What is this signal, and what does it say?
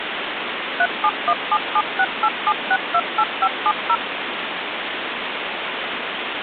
DTMF, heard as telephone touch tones, dialled by machine, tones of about 60 ms, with phone line noise. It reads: 37177687628570